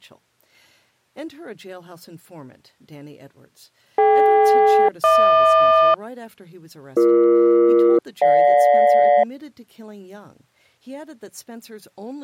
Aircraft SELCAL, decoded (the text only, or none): DK-HQ BE-GJ